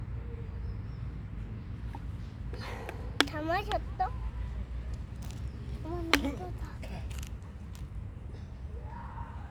The noise of a residential street. There is no code.